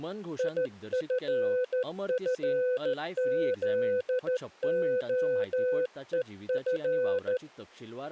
Morse code, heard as a keyed tone, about 14 wpm, 500 Hz, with speech in Goan Konkani. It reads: IFFZOEF